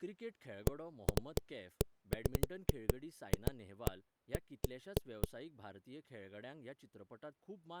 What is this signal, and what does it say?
Irregular knocks on a wall, with speech in Goan Konkani. There is no code.